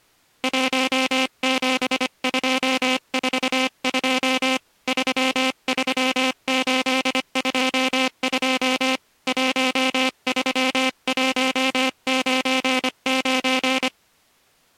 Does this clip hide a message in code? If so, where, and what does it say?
Yes: Morse code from 0.4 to 13.9 s, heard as a buzzer, hand-sent with a paddle, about 25 wpm. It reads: 17242 33822 13199